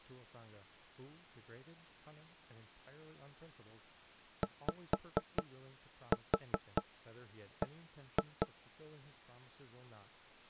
Tap code, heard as knocks on wood, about 4 knocks a second, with speech in English. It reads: YB